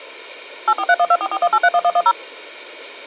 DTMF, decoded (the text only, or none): 84312441831110